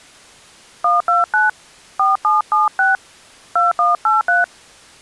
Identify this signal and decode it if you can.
DTMF, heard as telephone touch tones, dialled by hand, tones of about 160 ms. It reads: 129 4776 2183